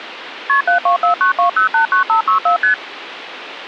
Multi-frequency trunk signalling (R1, as on North American trunks), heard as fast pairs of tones, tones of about 110 ms, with phone line noise. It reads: KP 72492089564 ST